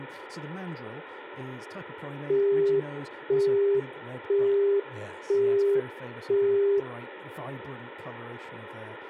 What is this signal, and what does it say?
Telephone call progress tone (single-tone plan, as in Europe, Japan and elsewhere), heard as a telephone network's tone, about 400 Hz, 0.5 s on and 0.5 s off, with phone line noise and speech in English. Busy tone.